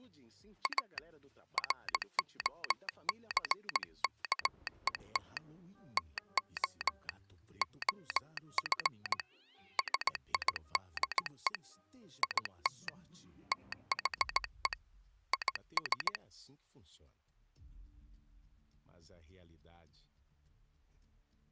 Morse code, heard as a telegraph sounder, hand-sent with a straight key, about 17 wpm. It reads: A ROCKET TO OF SIDE IT THE IS